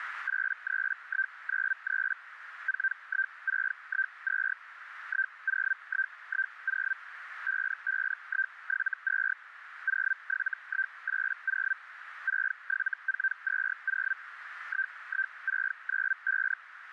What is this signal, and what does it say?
Hellschreiber (Feld-Hell, 122.5 baud), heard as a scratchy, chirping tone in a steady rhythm, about 1550 Hz, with radio static and a narrow filter. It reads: 83193 41612 10110 55172 07180 67420 11695